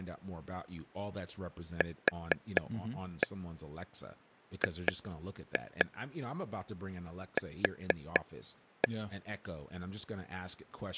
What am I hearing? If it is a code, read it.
Tap code, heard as taps on a table, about 4 knocks a second, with speech in English. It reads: QGQ